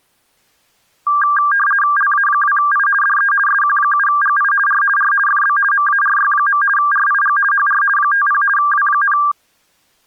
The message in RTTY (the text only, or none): LA2I DE SQ7GI R R FB MARY. RIG HR 50 W,